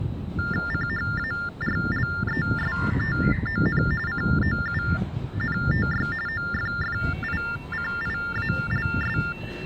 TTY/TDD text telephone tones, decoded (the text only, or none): CHARLESTON COUNTY OFFICIALS